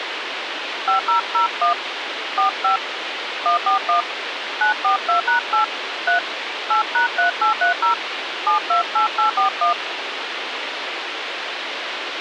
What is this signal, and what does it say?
DTMF, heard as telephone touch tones, dialled by hand, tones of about 120 ms, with radio hiss. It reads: 5001 45 141 942#8 3 8#3830 728841